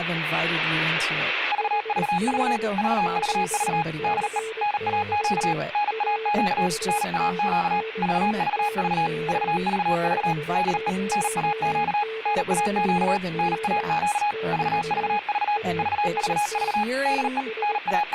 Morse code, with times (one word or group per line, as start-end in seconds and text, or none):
1.5-2.6 VVV
2.8-3.8 VVV
4.0-4.4 DE
4.6-5.5 NAQ
5.7-6.7 NAQ
6.9-7.8 NAQ
8.0-9.1 VVV
9.3-10.3 VVV
10.5-10.9 DE
11.1-12.0 NAQ
12.3-13.2 NAQ
13.4-14.3 NAQ
14.5-15.6 VVV
15.8-16.8 VVV
17.1-17.4 DE
17.6-18.1 …